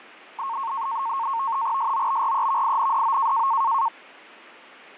NAVTEX (SITOR-B), 100 baud, 170 Hz shift, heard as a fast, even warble, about 1000 Hz centre, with radio static. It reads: SOBREVINDO